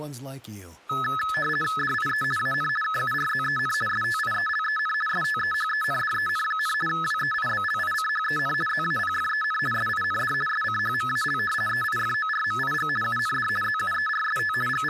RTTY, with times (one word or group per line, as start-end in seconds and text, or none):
1.8-2.2 DIE
2.4-2.7 AN
2.8-3.7 KURZEN
3.9-4.9 STIELEN
5.1-6.7 STEHENDEN,
6.9-8.5 WEIBLICHEN
8.7-9.6 ZAPFEN
9.7-10.3 SIND
10.5-11.4 SCHMAL
11.7-12.9 EIFORMIG
13.0-13.5 UND
13.6-14.5 ZUERST
14.7-14.9 …